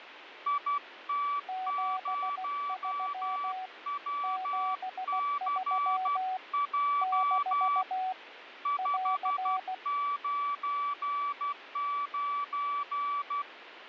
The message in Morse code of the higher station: IT0WCJ 599

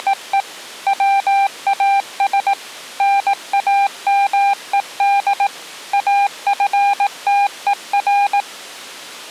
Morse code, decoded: … WAS NAMED AFTER

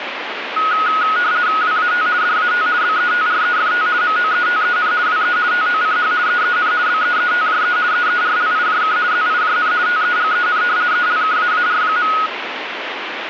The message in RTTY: WAT DAT BETREFT MOETEN WE TOCH EEN BEETJE EERLIJK ZIJN TEGEN ELKAAR.

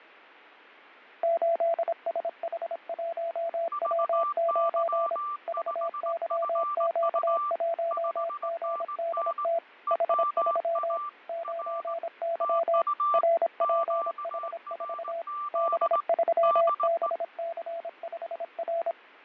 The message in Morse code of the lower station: 8SH1W9 VYQ1GDT H3 9Y RPH4 B3BC5R

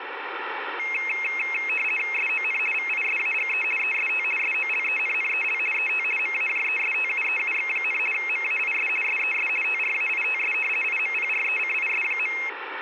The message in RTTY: SON VISAGE EST SOLENNEL ET MAJESTUEUX, MAIS SES TRAITS IMPRECIS.

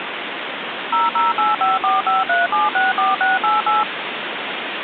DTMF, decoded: 0085453764688

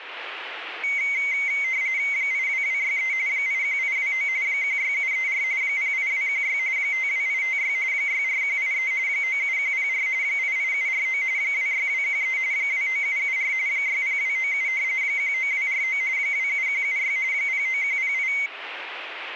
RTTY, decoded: 82263 81829 16734 08216 52856 64183 97104 88749 26213 29774 60297 19249 27176 09108

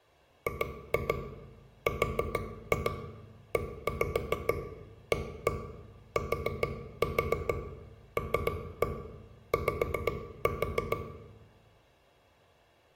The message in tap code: GREATLY

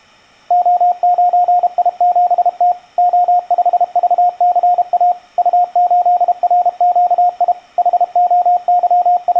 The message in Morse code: O9I7T O5VCA U8RQI …

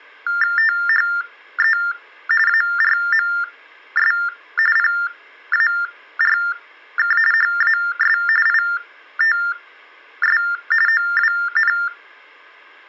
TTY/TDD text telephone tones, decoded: THE ARMS PARK HAS ITS OWN

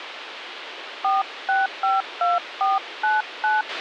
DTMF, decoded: 4652499

